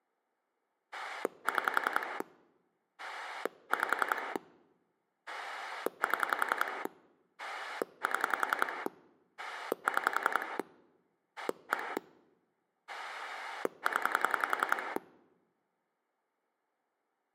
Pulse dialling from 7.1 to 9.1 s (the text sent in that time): 7